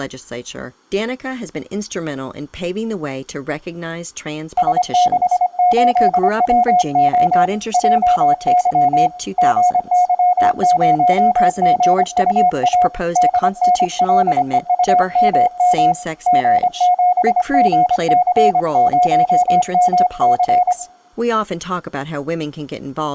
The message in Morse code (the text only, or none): S68WO JY GY0GUA DNLEUMM G7GC0MC